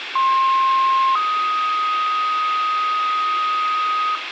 Two-tone page, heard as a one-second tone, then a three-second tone, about 1060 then 1250 Hz, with radio hiss and room echo.